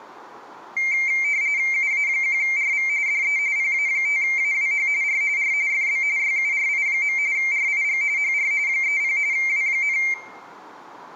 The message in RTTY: UA1RV DE PA5AWH R R FB YURI. RIG HR 30 W,

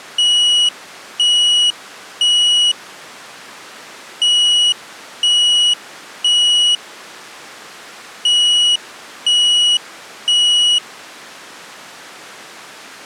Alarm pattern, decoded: temporal three

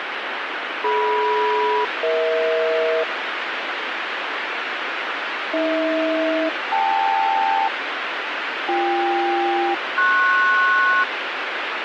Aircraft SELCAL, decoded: DM-EH AH-KL BK-PS

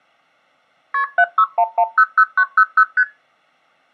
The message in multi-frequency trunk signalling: KP 761100900 ST

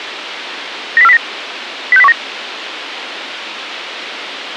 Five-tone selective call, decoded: 90409 06019

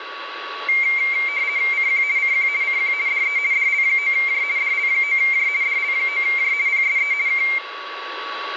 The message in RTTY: CQ CQ CQ DE DL9J DL9J DL9J PSE K

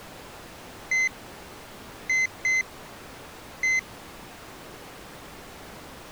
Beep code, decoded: 1-2-1

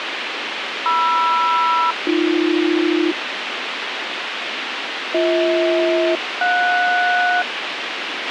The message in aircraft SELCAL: MR-AB BH-JS

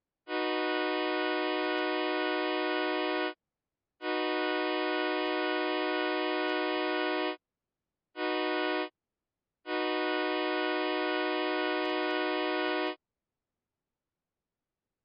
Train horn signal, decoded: 2 long, 1 short, 1 long

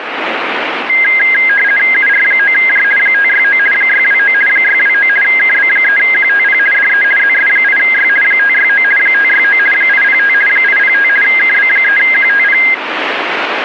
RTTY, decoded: UR9J 569 629 629 KB3QTP DE ZS8Y 569 569 805 805 KB3QTP

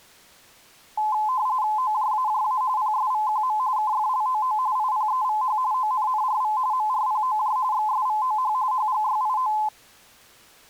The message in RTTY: OJAJA PSVQM KFLOO IPEVH ONNRV MRPOJ XSVOH HGYIO

